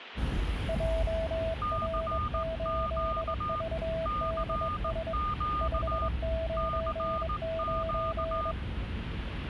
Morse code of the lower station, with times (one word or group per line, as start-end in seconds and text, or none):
0.7-5.1 JR8VDS
5.6-8.5 599